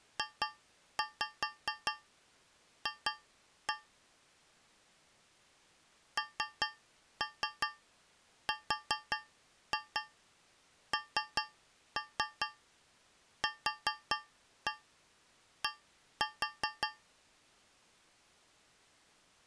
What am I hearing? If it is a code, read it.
Tap code, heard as taps on a metal pipe, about 5 knocks a second. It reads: JF NRNQD